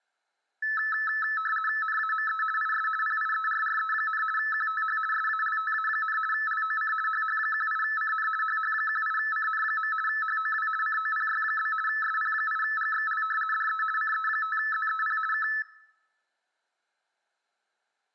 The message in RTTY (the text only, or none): NAME IS PIERRE, QTH SALTA, LOC HH18CN HH18CN. HOW COPY? SP8GXL DE CE5ZEP K